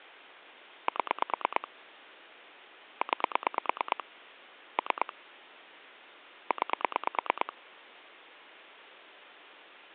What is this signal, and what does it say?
Pulse dialling, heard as clicks on a phone line, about 9 pulses a second. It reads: 7 9 3 9